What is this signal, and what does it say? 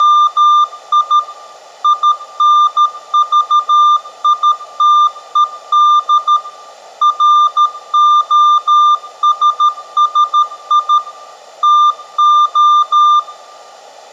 Morse code, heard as a keyed tone, machine-sent, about 13 wpm, 1200 Hz, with room echo. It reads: … INVITED ROSSI TO